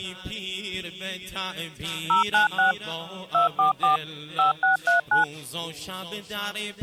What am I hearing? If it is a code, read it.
DTMF, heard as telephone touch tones, dialled by machine, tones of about 130 ms. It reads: 096 244 5639